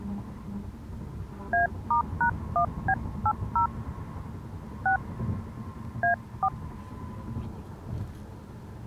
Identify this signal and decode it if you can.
DTMF, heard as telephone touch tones, dialled by hand, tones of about 100 ms, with the noise inside a car. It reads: A*#1B80 6 A4